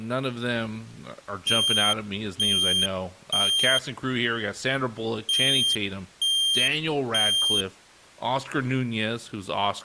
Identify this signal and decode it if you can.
Alarm pattern, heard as an alarm's beeps, played twice, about 3200 Hz, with speech in English. Temporal three. Smoke or fire, evacuate.